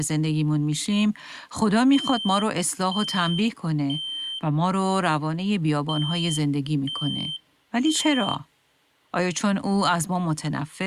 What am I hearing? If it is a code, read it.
Alarm pattern, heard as an alarm's beeps, played twice, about 3100 Hz, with speech in Persian. Temporal three. Smoke or fire, evacuate.